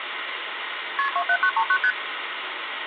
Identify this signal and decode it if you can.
Multi-frequency trunk signalling (R1, as on North American trunks), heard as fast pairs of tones, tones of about 70 ms, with phone line noise. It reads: KP 27939 ST